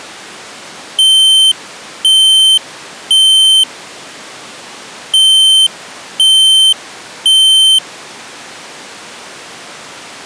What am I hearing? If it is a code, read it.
Alarm pattern, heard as an alarm's beeps, played twice, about 3100 Hz. Temporal three. Smoke or fire, evacuate.